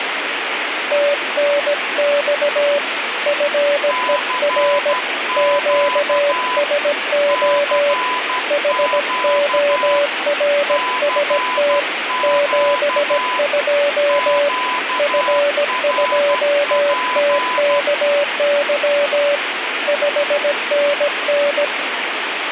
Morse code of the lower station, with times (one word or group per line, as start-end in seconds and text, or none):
0.9-2.8 TNX
3.3-4.9 FER
5.4-7.9 QSO
8.5-11.8 HORST
12.2-14.5 72
15.0-19.4 F2TKY
19.9-21.6 5NN